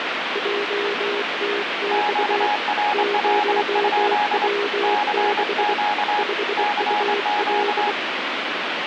Morse code, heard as two keyed tones, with radio static. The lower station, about 24 wpm, 410 Hz: JTX 0W6 5UL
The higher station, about 26 wpm, 830 Hz: QRL? CQ CQ